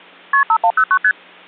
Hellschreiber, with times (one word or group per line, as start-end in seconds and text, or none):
none